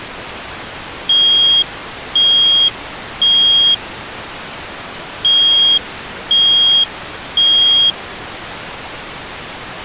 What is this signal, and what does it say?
Alarm pattern, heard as an alarm's beeps, played twice, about 3250 Hz. Temporal three. Smoke or fire, evacuate.